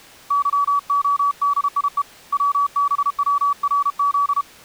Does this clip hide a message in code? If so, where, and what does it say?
Yes: Morse code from 0.2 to 4.5 s, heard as a keyed tone, hand-sent with a paddle, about 32 wpm, 1140 Hz. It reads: YODIE WBWRZ